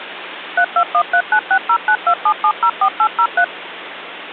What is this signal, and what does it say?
DTMF, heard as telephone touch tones, dialled by machine, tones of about 70 ms, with phone line noise. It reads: 3213960927704803